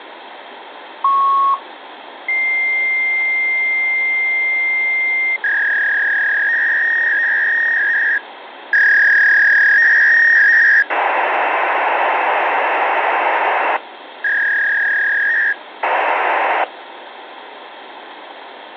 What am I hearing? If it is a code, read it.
Fax machine handshake, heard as a beep, a long tone, a warble and hiss, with phone line noise.